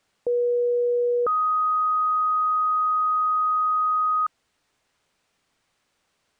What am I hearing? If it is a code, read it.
Two-tone page, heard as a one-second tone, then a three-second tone, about 480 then 1250 Hz.